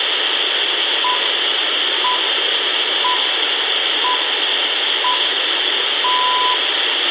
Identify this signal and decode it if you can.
Radio time signal (six pips, as the Greenwich Time Signal), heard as pips, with radio hiss, a squelch burst at the end and room echo.